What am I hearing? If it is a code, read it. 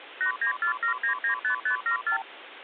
Multi-frequency trunk signalling (R2, with the far end's replies), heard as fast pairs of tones, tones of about 100 ms, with phone line noise. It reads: 8947995574